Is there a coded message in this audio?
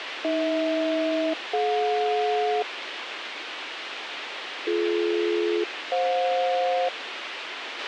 Yes: aircraft SELCAL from 0.2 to 6.9 s, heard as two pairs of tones, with radio hiss and a squelch burst at the end. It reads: AH-DJ BD-FJ